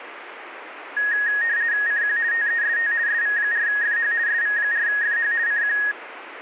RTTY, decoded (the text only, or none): CQ TEST SV4FH SV4FH CQ